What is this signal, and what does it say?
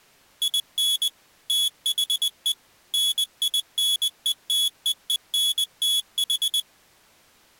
Morse code, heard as a high beeper, machine-sent, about 20 wpm, 3400 Hz. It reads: IN THE NINETEENTH